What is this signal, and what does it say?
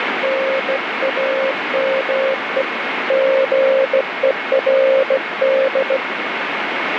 Morse code, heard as a keyed tone, hand-sent with a straight key, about 16 wpm, 530 Hz, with heavy radio static. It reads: NAME GERD